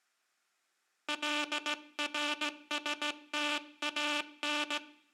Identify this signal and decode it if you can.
Morse code (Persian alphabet), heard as a buzzer, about 16 wpm, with room echo. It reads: لرستان